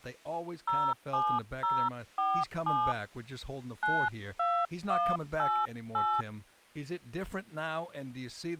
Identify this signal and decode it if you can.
DTMF, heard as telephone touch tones, dialled by hand, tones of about 260 ms, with speech in English. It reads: 07047 92188